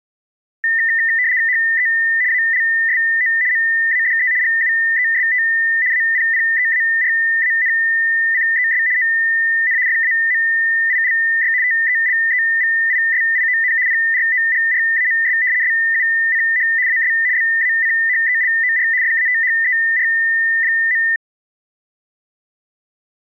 RTTY (75 baud, 170 Hz shift), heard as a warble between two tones, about 1900 Hz centre. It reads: HE ALSO MADE GUEST APPEARANCES ON FAMILY TELEVISION PROGRAMS SUCH AS BACHELOR FATHER.